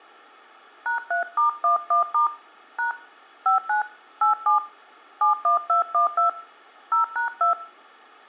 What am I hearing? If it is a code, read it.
DTMF, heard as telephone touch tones, dialled by hand, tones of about 120 ms. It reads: #3*11* # 59 87 71212 0#2